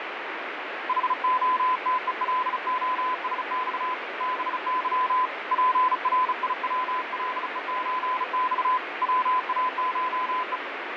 Morse code (Russian alphabet), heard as a keyed tone, hand-sent with a bug key, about 35 wpm, 1010 Hz, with radio static and fading. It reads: ХОТЕЛОСЬ БЫ ПРИВЛЕЧЬ ВАШЕ